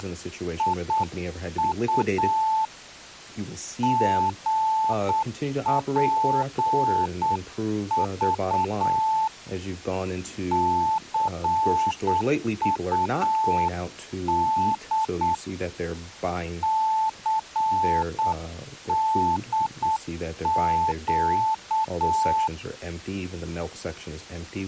Morse code, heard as a keyed tone, hand-sent with a paddle, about 8 wpm, 880 Hz, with speech in English. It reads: … GPV CUD CDQ